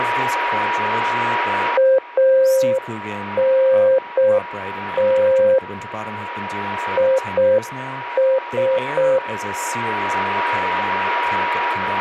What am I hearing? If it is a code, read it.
Morse code, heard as a keyed tone, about 6 wpm, 530 Hz, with radio static, a steady whistle near 960 Hz and speech in English. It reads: ANT IS